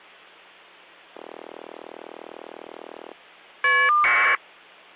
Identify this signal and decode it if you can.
Caller ID data burst, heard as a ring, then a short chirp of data, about 1200 baud.